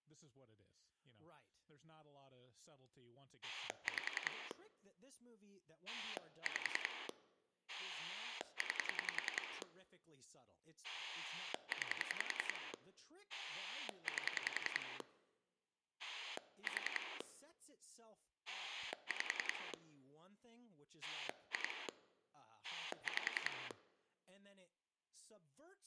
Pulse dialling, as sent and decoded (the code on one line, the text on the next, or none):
5 / 5 / 9 / 9 / 8 / 4 / 5 / 2 / 5
5 5 9 9 8 4 5 2 5